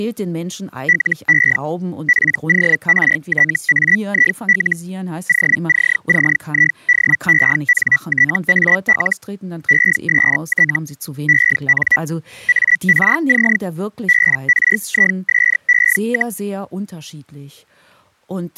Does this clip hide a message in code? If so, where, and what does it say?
Yes: Hellschreiber (Feld-Hell, 122.5 baud) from 0.9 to 16.4 s, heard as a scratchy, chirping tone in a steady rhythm, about 1950 Hz, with speech in German. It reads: LE PORTAIL OCCIDENTAL EST EN ARC BRISE,